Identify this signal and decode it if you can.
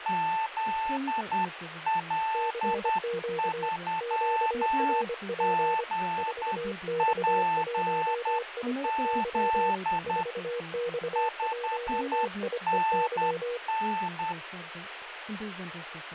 Morse code, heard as two keyed tones, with radio static and speech in English. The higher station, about 10 wpm, 880 Hz: ZL3GPZ 5NN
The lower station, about 25 wpm, 480 Hz: CQ QRP 4X1IEY 4X1IEY